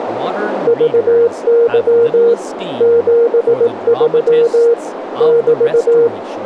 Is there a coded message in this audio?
Yes: Morse code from 0.6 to 6.1 s, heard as a keyed tone, machine-sent, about 18 wpm, 470 Hz, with radio static, a narrow filter and speech in English. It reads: VY 73 <BT>